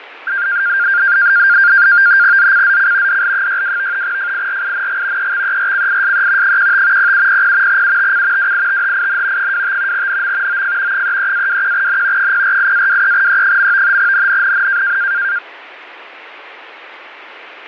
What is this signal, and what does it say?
NAVTEX (SITOR-B), 100 baud, 170 Hz shift, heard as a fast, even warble, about 1500 Hz centre, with radio static and fading. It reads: ZCZC DL62 FIRING EXERCISE 15 0700 UTC WITHIN 25 NM OF 33-21N 048-23E. NNNN